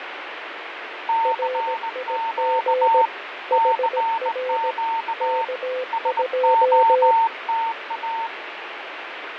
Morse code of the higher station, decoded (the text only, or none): CQ CQ SOTA